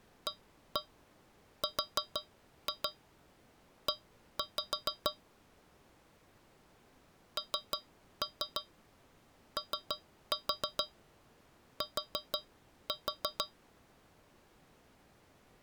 Tap code, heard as taps on a metal pipe, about 6 knocks a second. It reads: ARE NOT